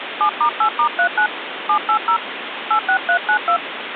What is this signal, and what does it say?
DTMF, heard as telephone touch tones, dialled by hand, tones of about 90 ms, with phone line noise. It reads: 7*8*39 780 86392